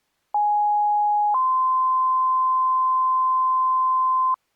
Two-tone page, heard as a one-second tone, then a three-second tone, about 830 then 1040 Hz.